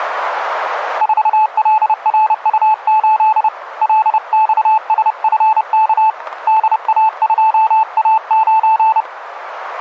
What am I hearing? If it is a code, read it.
Morse code, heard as a keyed tone, hand-sent with a paddle, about 30 wpm, 870 Hz, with radio static. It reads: 4LRU8 LXSFK DA2A9